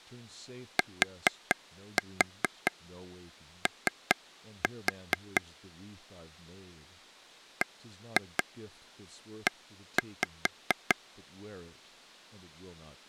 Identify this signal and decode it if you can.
Tap code, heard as taps on a table, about 4 knocks a second, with speech in English. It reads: TO BE